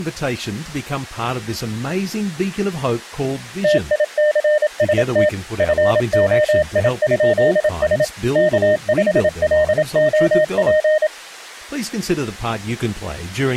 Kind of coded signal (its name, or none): Morse code